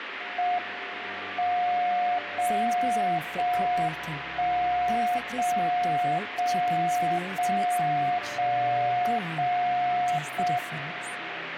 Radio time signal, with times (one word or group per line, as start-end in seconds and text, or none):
0.4-1.4 M
1.4-2.4 0
2.4-3.4 0
3.4-4.4 1
4.4-5.4 0
5.4-6.4 0
6.4-7.4 0
7.4-8.4 0
8.4-9.4 0
9.4-10.4 0
10.4-11.4 M